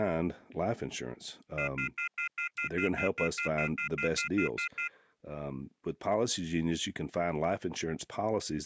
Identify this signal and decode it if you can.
Telephone call progress tone (North American plan), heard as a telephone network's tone, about 1400, 2050, 2450, 2600 Hz, 0.1 s on and 0.1 s off, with speech in English. Off-hook warning tone.